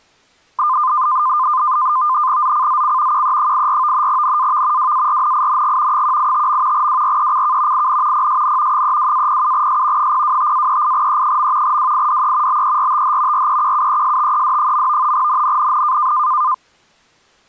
NAVTEX (SITOR-B), 100 baud, 170 Hz shift, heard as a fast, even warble, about 1120 Hz centre. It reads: ZCZC QE84 NAV WARNING 185. WRECK IN PSN 32-07S 025-38E. WIDE BERTH REQUESTED. NNNN